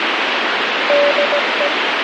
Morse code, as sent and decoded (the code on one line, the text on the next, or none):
-.. .
DE